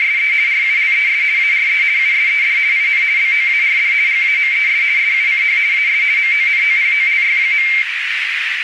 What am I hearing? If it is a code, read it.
RTTY (50 baud, 170 Hz shift), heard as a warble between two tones, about 2200 Hz centre, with radio static and a narrow filter. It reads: … RULES ARE USED IN BOARD GAMES SUCH AS MONOPOLY.